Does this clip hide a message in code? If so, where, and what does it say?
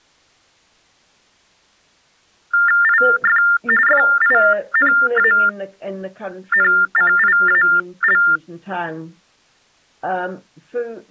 Yes: TTY/TDD text telephone tones (45.45 baud Baudot) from 2.5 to 8.4 s, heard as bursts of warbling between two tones, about 400 Hz shift, 1600 Hz centre. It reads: IF FINANCIAL